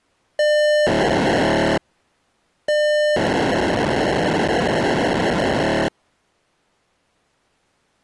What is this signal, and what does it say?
POCSAG pager data (1200 baud), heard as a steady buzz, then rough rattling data.